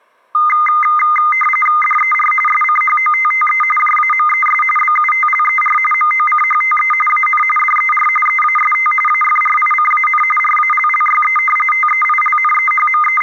RTTY (45.45 baud, 850 Hz shift), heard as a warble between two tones, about 1650 Hz centre. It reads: DER SCHOTTE JAMES BUTLER MOCHTE AN DER EAST AFRICAN RALLYE …